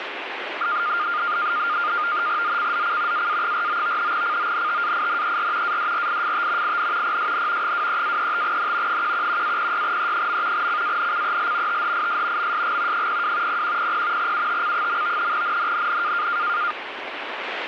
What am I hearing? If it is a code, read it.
NAVTEX (SITOR-B), 100 baud, 170 Hz shift, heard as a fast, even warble, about 1310 Hz centre, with radio static. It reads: ZCZC AA49 CONTAINER ADRIFT IN PSN 23-35N 111-06E. CANCEL THIS MSG 02 0100 UTC. NNNN